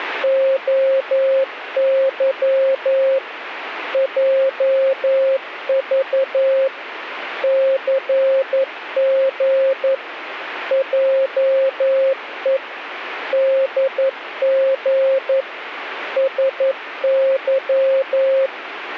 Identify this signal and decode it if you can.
Morse code, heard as a keyed tone, machine-sent, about 11 wpm, 540 Hz, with radio static. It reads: OY JV CG JE DG SY